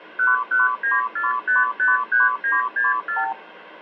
Multi-frequency trunk signalling (R2, with the far end's replies), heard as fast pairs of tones, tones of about 160 ms, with phone line noise. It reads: 1194553964